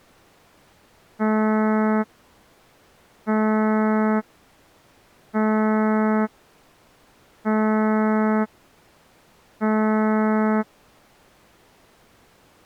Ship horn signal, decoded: 5 short

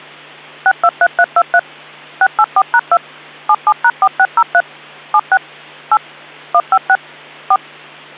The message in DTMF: 623323 684#2 77#4603 76 8 156 4

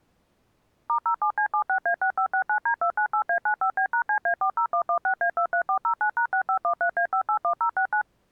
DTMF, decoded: *07C76A6569D298A95B#CA40116A23409#6513A581069

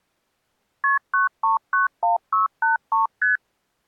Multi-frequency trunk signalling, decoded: KP 9391683 ST

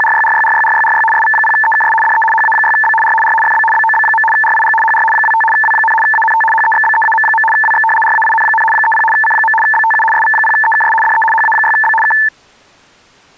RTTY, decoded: … SV0EKS DE HA6B R R FB BOB. RIG HR 25 W, ANT HEXBEAM. WX RAIN, 30 C. BTU SV0EKS DE HA6B K

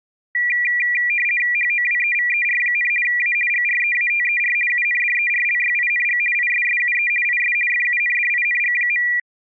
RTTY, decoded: HOWEVER, A GREATER UNDERLYING ISSUE IS FUNDING.

